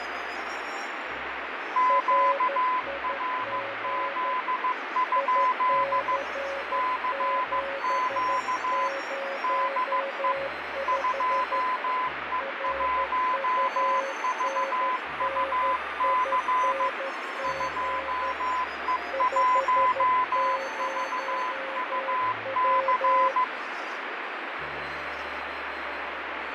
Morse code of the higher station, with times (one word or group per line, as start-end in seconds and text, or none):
1.8-6.2 QRZ?
6.7-8.9 CQ
9.4-10.3 DE
10.9-16.9 2E1VUC
17.4-23.4 2E1VUC